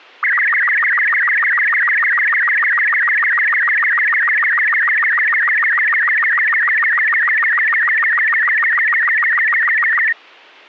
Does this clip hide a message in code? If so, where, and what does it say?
Yes: SSTV (slow-scan television), Robot 36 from 0.2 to 10.1 s, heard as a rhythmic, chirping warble.